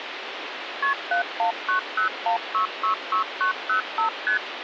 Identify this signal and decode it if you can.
Multi-frequency trunk signalling (R1, as on North American trunks), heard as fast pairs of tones, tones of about 110 ms, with phone line noise. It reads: KP 71901666905 ST